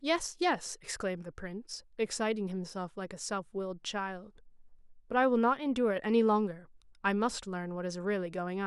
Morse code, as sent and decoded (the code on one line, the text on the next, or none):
none